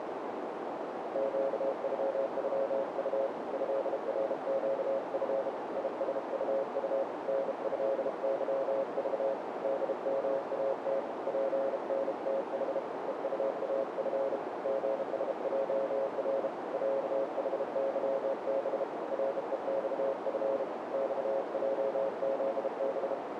Morse code (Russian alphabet), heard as a keyed tone, hand-sent with a bug key, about 32 wpm, 540 Hz, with heavy radio static and a narrow filter. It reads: ЩЮЮУ ЭРЩФ ИСУУ НЭЫЖ ДМАТ ПНТХ ЕУАФ ГСЙР ЯХЫБ РЕЬФ ЬЙЗБ